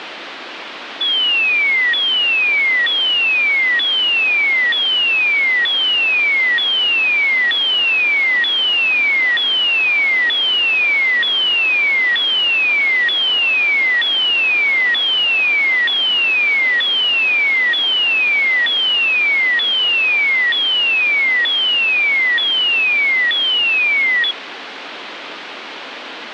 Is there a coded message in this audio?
No, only a tone that sweeps in pitch again and again, with radio static.